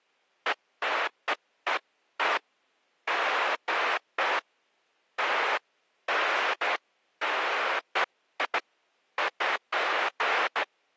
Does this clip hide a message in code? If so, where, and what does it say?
No, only bursts of noise.